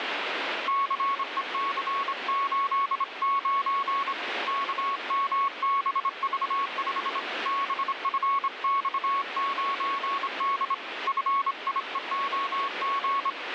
Morse code, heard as a keyed tone, hand-sent with a straight key, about 26 wpm, 1100 Hz, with radio static. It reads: CEC89 KMBV5 BFX9D FIEOG